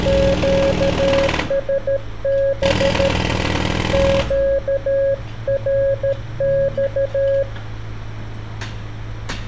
Morse code, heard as a keyed tone, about 13 wpm, 550 Hz, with street noise. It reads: QSB QRX